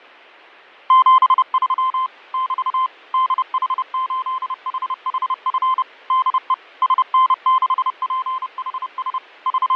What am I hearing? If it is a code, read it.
Morse code, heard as a keyed tone, machine-sent, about 30 wpm, 1040 Hz, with fading. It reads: 73 <BT> DH8HHF DE SN6PHS …